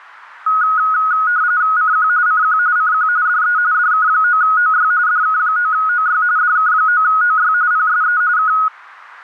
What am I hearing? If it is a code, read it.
RTTY (45.45 baud, 170 Hz shift), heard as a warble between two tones, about 1360 Hz centre. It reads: CQ CQ CQ DE DK9OY DK9OY DK9OY PSE K